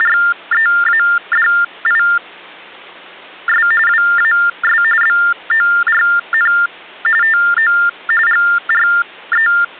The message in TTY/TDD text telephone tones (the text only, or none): … WAS BORN TO …